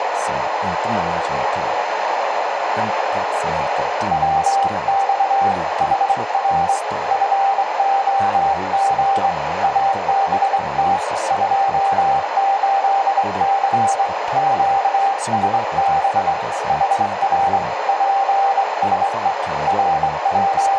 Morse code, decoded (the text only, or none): WX HR FOG ABT 28C QSB HR PSE …